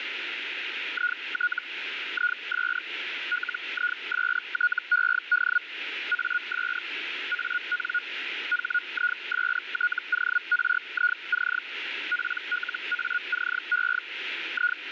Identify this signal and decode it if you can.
Hellschreiber (Feld-Hell, 122.5 baud), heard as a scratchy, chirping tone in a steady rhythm, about 1450 Hz, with radio static. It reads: IT IS LISTED AS AN HISTORIC PLACE …